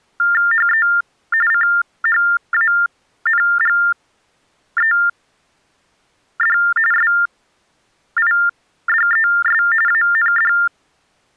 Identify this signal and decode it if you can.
TTY/TDD text telephone tones (45.45 baud Baudot), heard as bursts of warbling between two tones, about 400 Hz shift, 1600 Hz centre. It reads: HE CHANGED SIDES AND